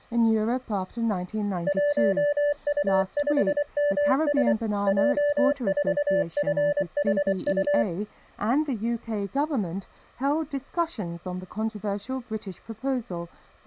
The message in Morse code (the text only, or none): 1U5MS J4FHU